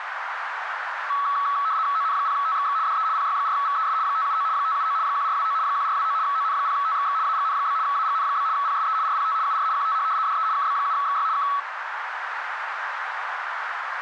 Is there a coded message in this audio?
Yes: RTTY (75 baud, 170 Hz shift) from 1.1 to 11.6 s, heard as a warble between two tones, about 1210 Hz centre, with radio static and a narrow filter. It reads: ON0TXX DE PY4VES 579 579 1429 1429 ON0TXX AGN? AGN? PSE RPT UR QTH DE KB7XY K